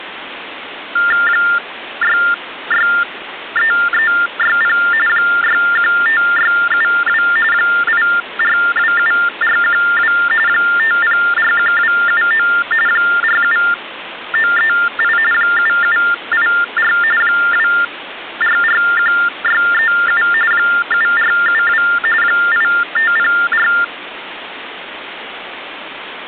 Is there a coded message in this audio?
Yes: TTY/TDD text telephone tones (45.45 baud Baudot) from 1.0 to 23.8 s, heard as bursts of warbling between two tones, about 400 Hz shift, 1600 Hz centre, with phone line noise. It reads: 663360 615672 8427412 5041279 47938 7784 2441637 7472 8504